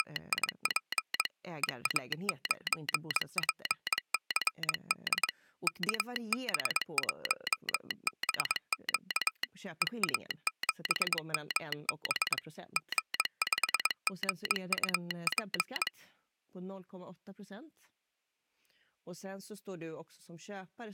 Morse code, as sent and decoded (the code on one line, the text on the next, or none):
… / . .- ----. .--. -.-. -.. / -.- -... .---- -... --.- / . .- --... -- -... / --. ..... --. ..- .--.
… EA9PCD KB1BQ EA7MB G5GUP